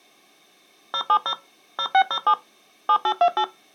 DTMF, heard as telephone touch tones, dialled by machine, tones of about 70 ms. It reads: 070 0607 7828